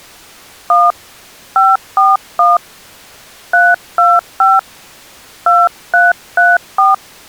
DTMF, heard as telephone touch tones, dialled by hand, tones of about 180 ms. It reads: 1 541 325 2334